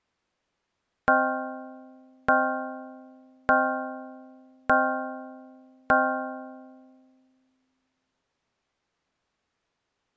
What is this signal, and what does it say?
Clock strike, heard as a bell. 5. Five o'clock.